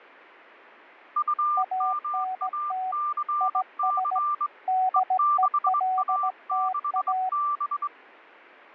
Morse code, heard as two keyed tones. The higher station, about 23 wpm, 1180 Hz: UMACC E6A6B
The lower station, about 17 wpm, 750 Hz: ANT IS DELTA